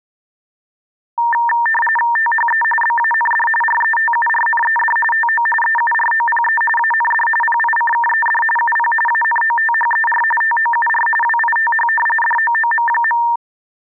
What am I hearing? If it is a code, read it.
RTTY (45.45 baud, 850 Hz shift), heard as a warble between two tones, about 1360 Hz centre. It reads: THE BAND RETURNED TO EUROPE AND PICKED UP ANOTHER TOUR WITH DOOM.